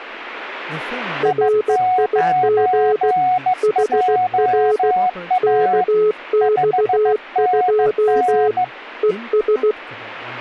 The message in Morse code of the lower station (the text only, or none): RIG HR KX2 ES